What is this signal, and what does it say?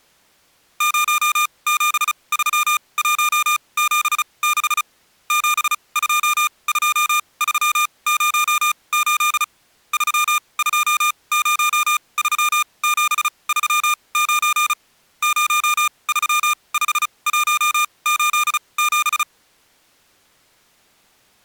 Morse code, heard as electronic beeps, machine-sent, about 35 wpm, spaced as for 25 wpm, 1210 Hz. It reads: 073176 722308 3203739 035187